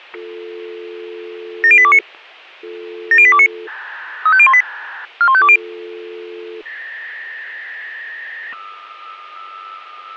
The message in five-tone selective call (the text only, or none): 70829 70829 35018 41520